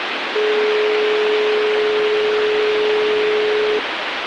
Telephone call progress tone (425 Hz plan, as in most of Europe), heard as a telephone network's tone, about 420 Hz, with phone line noise. Dial tone.